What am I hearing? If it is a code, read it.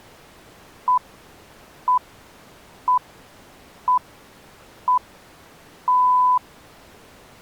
Radio time signal (six pips, as the Greenwich Time Signal), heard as pips.